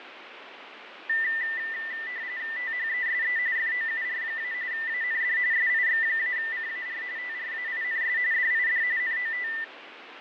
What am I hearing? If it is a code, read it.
RTTY (45.45 baud, 170 Hz shift), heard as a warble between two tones, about 1900 Hz centre, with radio static and fading. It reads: THESE FOUR- AND SIX-CAR TRAINS DID NOT